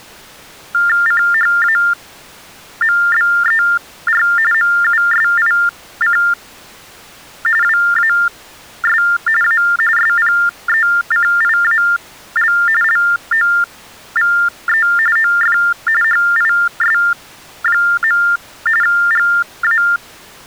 TTY/TDD text telephone tones (45.45 baud Baudot), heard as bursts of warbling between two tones, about 400 Hz shift, 1600 Hz centre. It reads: CHAMBER MUSIC WAS A SPECIAL LOVE OF HIS. GA